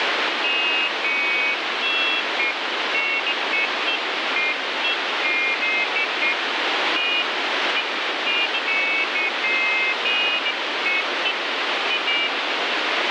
Pairs of high tones at irregular times, with heavy radio static. There is no code.